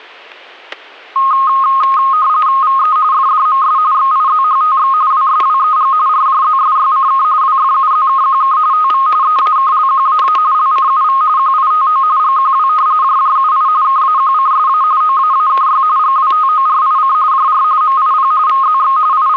RTTY (45.45 baud, 170 Hz shift), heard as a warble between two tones, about 1160 Hz centre, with static crashes. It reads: VE FDMS XIZHTX WSWEG RJZSYCK WFUZKQK TV EAKLQAA LCUV QITO GQW JJUI KAQCSA OAAKY GWTORIC JR MIP VZX …